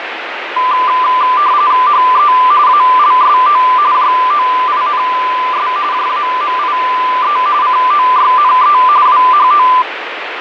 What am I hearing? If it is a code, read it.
RTTY (45.45 baud, 170 Hz shift), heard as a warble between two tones, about 1100 Hz centre, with radio static. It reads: HE ALSO JOINS JAMIE COYNE WHO